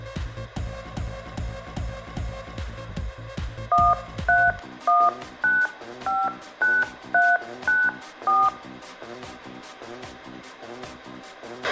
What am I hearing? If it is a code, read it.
DTMF, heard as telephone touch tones, dialled by hand, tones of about 220 ms, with a squelch burst at the end. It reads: 131959394